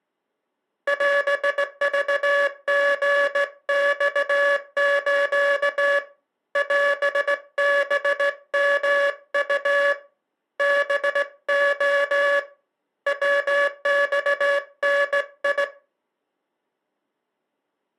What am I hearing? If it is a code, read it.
Morse code (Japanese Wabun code), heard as a buzzer, hand-sent with a straight key, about 17 wpm. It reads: オクリマス オハヨウ ハレ ヤマダ